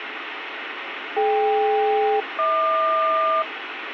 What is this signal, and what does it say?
Aircraft SELCAL, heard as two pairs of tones, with radio static. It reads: DK-HQ